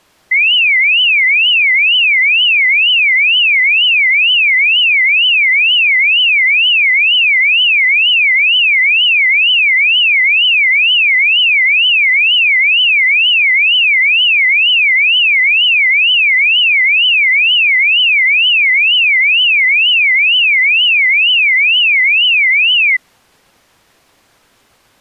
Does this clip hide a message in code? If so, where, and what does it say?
No, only a tone that sweeps in pitch again and again.